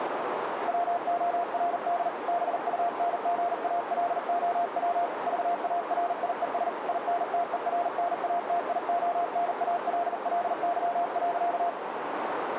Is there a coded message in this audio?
Yes: Morse code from 0.6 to 11.8 s, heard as a keyed tone, hand-sent with a paddle, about 40 wpm, 700 Hz, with radio static and a narrow filter. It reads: WORD BUNGALOW VARIES INTERNATIONALLY.